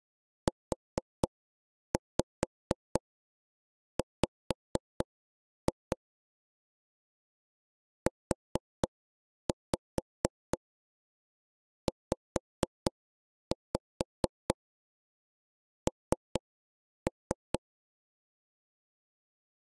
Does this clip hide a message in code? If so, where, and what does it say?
Yes: tap code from 0.5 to 17.6 s, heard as taps on a table, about 4 knocks a second. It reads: UW UZN